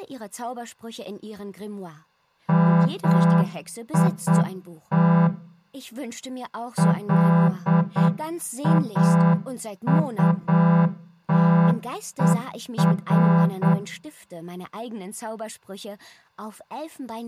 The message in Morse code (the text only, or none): MIT LAUTER